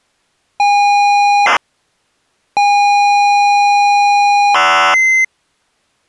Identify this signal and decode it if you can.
ZX Spectrum tape loading, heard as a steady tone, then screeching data.